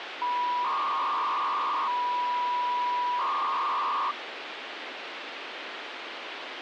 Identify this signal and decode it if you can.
300-baud modem data (V.21 tones), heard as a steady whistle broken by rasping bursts, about 300 baud, 200 Hz shift, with phone line noise.